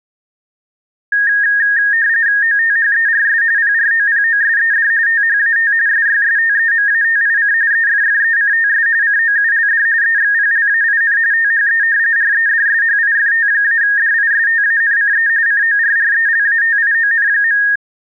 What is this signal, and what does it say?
RTTY (45.45 baud, 170 Hz shift), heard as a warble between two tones, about 1750 Hz centre. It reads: OTHERS PROPOSED THAT SYSTEMATIC EFFECTS COULD EXPLAIN THE REDSHIFT-DISTANCE CORRELATION.